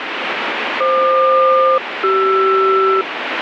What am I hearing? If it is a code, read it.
Aircraft SELCAL, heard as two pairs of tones, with radio static. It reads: FQ-CR